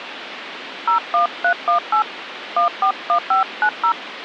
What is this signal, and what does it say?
DTMF, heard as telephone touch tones, dialled by hand, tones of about 100 ms, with phone line noise. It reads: 01318 141590